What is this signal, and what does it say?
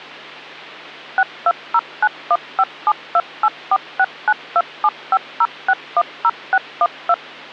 DTMF, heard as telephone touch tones, dialled by machine, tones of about 50 ms, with hum. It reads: 6209157284692750610612